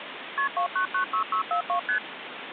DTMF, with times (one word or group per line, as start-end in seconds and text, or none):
none